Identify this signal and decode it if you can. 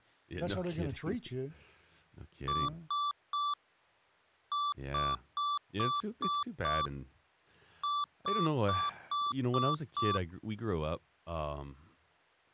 Beep code, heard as beeps from a small speaker, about 1160 Hz, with speech in English. 3-6-6.